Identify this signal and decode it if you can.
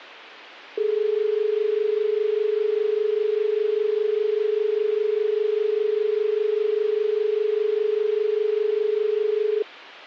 Telephone call progress tone (as in Australia), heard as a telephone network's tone, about 430 Hz. Dial tone.